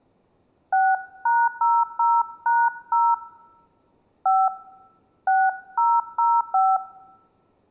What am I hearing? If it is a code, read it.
DTMF, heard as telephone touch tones, dialled by hand, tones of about 230 ms. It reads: 6#00#0 5 6005